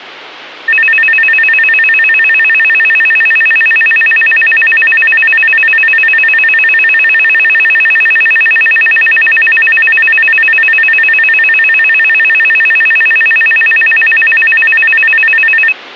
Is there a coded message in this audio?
No, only a tone that alternates evenly between two pitches, with hum.